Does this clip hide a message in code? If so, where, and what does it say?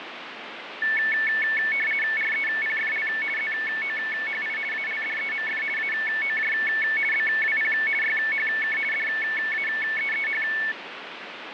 Yes: RTTY (50 baud, 450 Hz shift) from 0.8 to 10.7 s, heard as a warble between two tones, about 2000 Hz centre, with radio static. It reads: REPFL ZOHI ALDEMF AOJ BWP YHK DAEEH